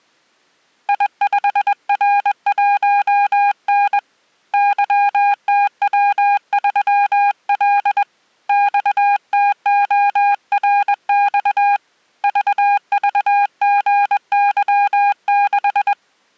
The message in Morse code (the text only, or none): I5R1N YTW3L XTORX VVGY6